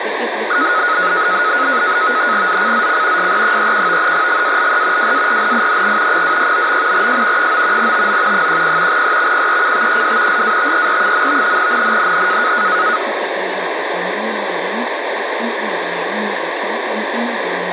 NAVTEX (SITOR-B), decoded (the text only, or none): ZCZC SE31 GALE WARNING 269. S 9 TO 10 EXPECTED LATER. NNNN